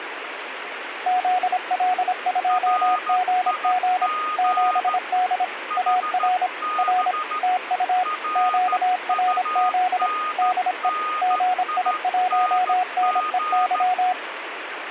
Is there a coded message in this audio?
Yes: Morse code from 1.0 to 14.2 s, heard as two keyed tones, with radio static. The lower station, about 26 wpm, 730 Hz: ZL2GG 7D AR R TU QRZ DE GI1NEY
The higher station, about 14 wpm, 1240 Hz: RIG HB RUNNING